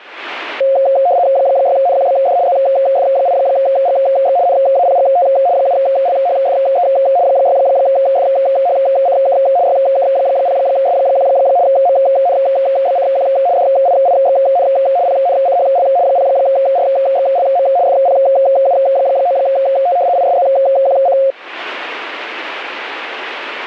RTTY (75 baud, 170 Hz shift), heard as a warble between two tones, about 620 Hz centre. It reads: 6NQBD ZF8GX NAPGT 7LHFE 6FHCK YK0S1 MNBCQ DIIXN PNCHL 0RXLM FPU9T ISZQC